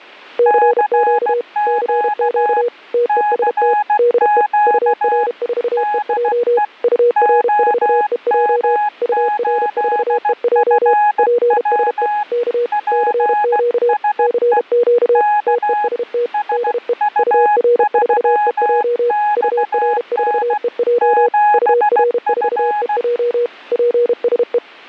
Morse code, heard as two keyed tones. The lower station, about 32 wpm, 480 Hz: CQ CQ TEST DE UR4EJ UR4EJ UR4EJ PSE K CQ CQ TEST DE UR4EJ UR4EJ UR4EJ PSE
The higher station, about 16 wpm, 840 Hz: CQ CQ DE OM8FW PSE K SU3XN 7F